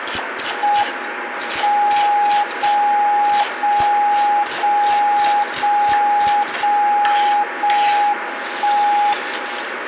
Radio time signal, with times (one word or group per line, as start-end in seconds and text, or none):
0.6-1.6 M
1.6-2.6 0
2.6-3.6 0
3.6-4.6 0
4.6-5.6 0
5.6-6.6 0
6.6-7.6 0
7.6-8.6 1
8.6-9.6 1